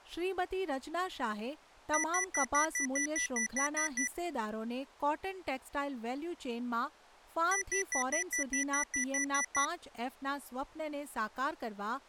Beep code, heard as beeps from a small speaker, played twice, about 1950 Hz, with speech in Gujarati. 11 short. In AMI BIOS tables: cache memory error.